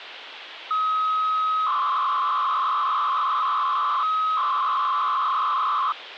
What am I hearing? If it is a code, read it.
300-baud modem data (Bell 103 tones), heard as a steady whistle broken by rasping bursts, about 300 baud, 200 Hz shift, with phone line noise.